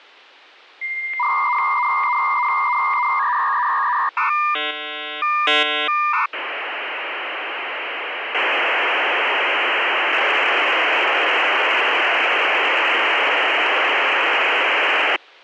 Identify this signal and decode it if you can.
Dial-up modem handshake (V.34 or later), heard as a whistle, warbles, then hiss.